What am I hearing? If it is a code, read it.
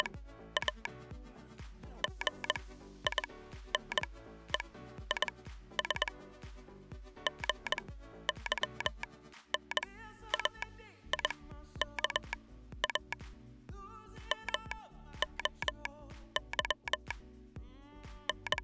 Morse code (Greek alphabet), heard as a telegraph sounder, machine-sent, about 21 wpm, spaced as for 12 wpm. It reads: … ΓΙΝΕΙΣ ΓΥΝΑΙΚΑ ΜΟΥ …